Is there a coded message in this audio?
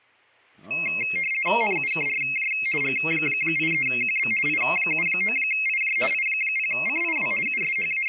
Yes: RTTY (50 baud, 450 Hz shift) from 0.7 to 8.1 s, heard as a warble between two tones, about 2350 Hz centre, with speech in English. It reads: NUKRJ G83QB I79IJ I0CIW …